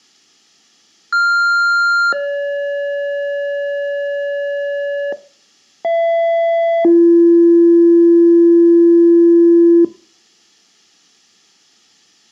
Two-tone page, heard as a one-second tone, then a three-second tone, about 1400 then 570 Hz, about 670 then 340 Hz.